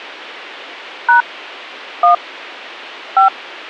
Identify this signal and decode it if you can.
DTMF, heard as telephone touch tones, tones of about 120 ms. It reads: # 1 5